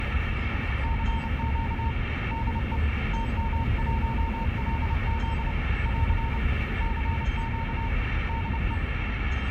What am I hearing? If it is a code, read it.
Morse code, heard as a keyed tone, hand-sent with a paddle, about 29 wpm, 910 Hz, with radio static and the noise inside a car. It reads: CQ DE TM1LZ <AR> CQ DE